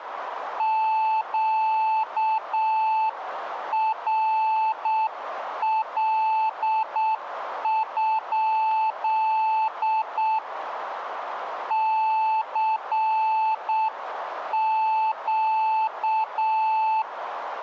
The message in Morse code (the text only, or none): QRL? CQ